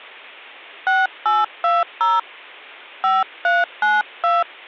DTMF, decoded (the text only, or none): 6820 5392